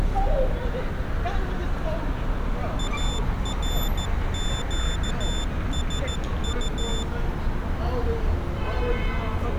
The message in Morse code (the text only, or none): ARQSU